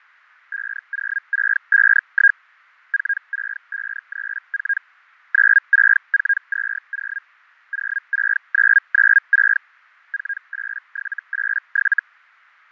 Hellschreiber (Feld-Hell, 122.5 baud), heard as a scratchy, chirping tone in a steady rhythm, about 1600 Hz, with fading. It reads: 50651 46534 96420 06996 48787